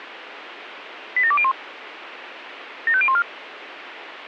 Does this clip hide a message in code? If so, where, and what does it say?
Yes: five-tone selective call (ZVEI) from 1.2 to 3.2 s, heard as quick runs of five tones, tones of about 70 ms, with radio hiss. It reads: 87201 75014